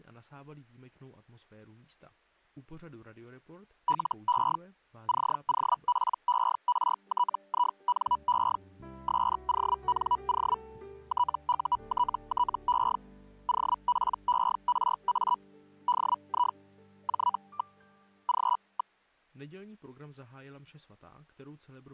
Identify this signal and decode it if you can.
Hellschreiber (Feld-Hell, 122.5 baud), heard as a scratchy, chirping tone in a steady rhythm, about 980 Hz. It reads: LE COPERTINE SONO TUTTE OPERA DI J. G.